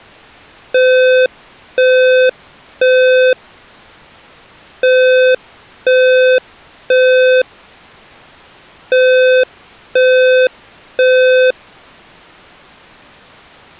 Alarm pattern, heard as an alarm's beeps, played three times, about 510 Hz. Temporal three. Smoke or fire, evacuate.